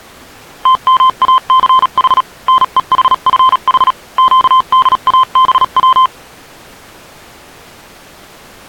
Morse code, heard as a keyed tone, machine-sent, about 37 wpm, spaced as for 34 wpm, 1040 Hz. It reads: TMACH NEHFH QDABW